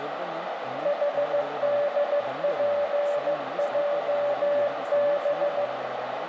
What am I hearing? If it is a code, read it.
Morse code, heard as a keyed tone, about 15 wpm, 580 Hz, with radio static, a narrow filter, room echo and speech in Kannada. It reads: HDPJB